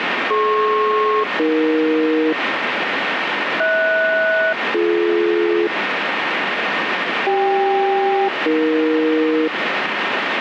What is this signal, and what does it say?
Aircraft SELCAL, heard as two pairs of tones, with radio static. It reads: DP-AE HS-BD CK-AE